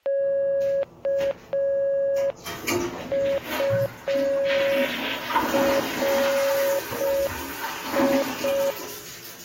Morse code, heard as a keyed tone, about 5 wpm, 550 Hz, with the noise of a restroom. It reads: KURI